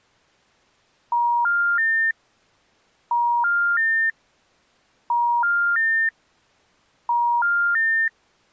Telephone call progress tone (ITU plan), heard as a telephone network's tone, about 950, 1400, 1800 Hz. Special information tone.